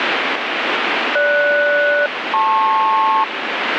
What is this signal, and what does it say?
Aircraft SELCAL, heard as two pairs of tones, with radio static. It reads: GS-LP